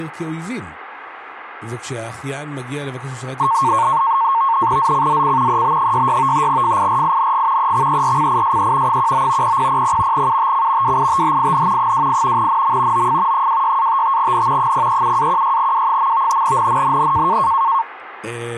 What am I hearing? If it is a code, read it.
NAVTEX (SITOR-B), 100 baud, 170 Hz shift, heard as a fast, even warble, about 1000 Hz centre, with radio static and speech in Hebrew. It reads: ZCZC EB66 FIRING EXERCISE 19 0000 UTC WITHIN 28 NM OF 26-55N 037-16W. NNNN